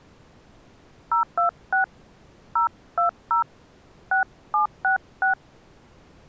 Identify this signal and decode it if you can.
DTMF, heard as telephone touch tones, dialled by hand, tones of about 120 ms. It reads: 026 020 6766